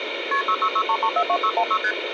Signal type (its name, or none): multi-frequency trunk signalling